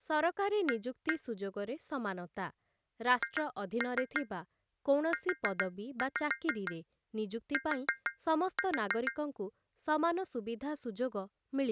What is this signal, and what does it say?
Tap code, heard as taps on glass, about 6 knocks a second, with speech in Odia. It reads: A HUT